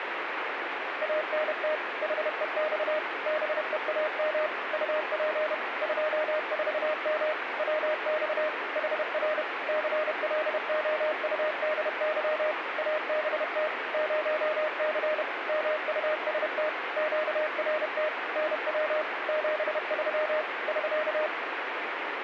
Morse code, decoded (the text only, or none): ANT HEX BEAM UP 24M WX HR CLOUDY ABT 0C MUST QRT NW 73 <SK>